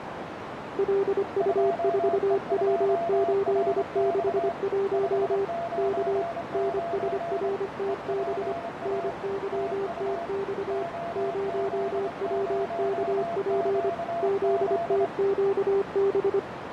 Morse code, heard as two keyed tones, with heavy radio static and a narrow filter. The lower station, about 25 wpm, 390 Hz: LU4W861 K NSRTB NYTX 0WKP ZTQB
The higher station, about 26 wpm, 680 Hz: 2E2RX 599 EPA TU OZ0QZ